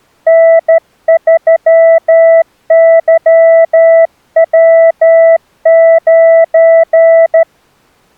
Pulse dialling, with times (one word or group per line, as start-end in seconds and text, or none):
none